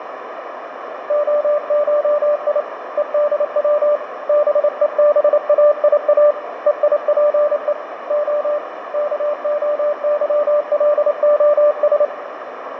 Morse code (Greek alphabet), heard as a keyed tone, hand-sent with a paddle, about 28 wpm, 590 Hz, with radio static, fading and a narrow filter. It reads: ΟΧΙ ΕΔΩ ΒΕΒΑΙΑ ΕΙΠΕ Ο ΚΟΥΛΟΣ